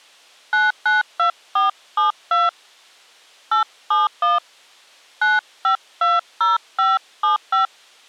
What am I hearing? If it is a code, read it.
DTMF, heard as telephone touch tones, dialled by hand, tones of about 150 ms. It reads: 992472 871 9520575